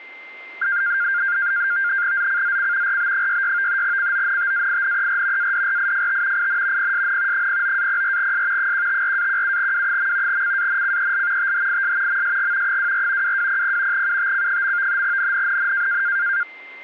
NAVTEX (SITOR-B), 100 baud, 170 Hz shift, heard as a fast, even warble, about 1500 Hz centre, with a steady whistle near 2090 Hz. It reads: ZCZC RB66 CONTAINER ADRIFT IN PSN 09-04S 154-17W. CANCEL THIS MSG 24 2200 UTC. NNNN